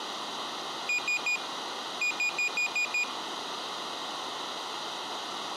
Beep code, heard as a piezo beeper, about 2450 Hz. 3-6.